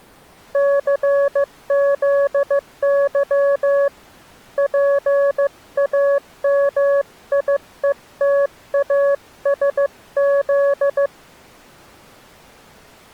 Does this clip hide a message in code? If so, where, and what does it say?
Yes: Morse code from 0.5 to 11.1 s, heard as a keyed tone, hand-sent with a paddle, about 15 wpm, 560 Hz. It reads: CZY PAMIETASZ